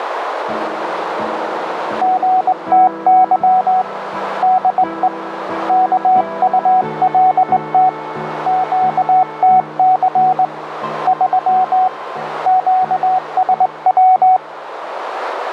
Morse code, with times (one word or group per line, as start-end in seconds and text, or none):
2.0-3.8 GTY
4.4-5.1 DE
5.7-7.9 KULT
8.5-10.4 QTC
11.1-11.9 3
12.5-14.4 QSW